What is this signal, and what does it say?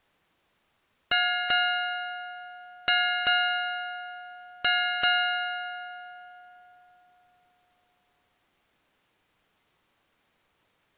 Ship's bell, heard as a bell. 6. Six half-hours of the watch have passed.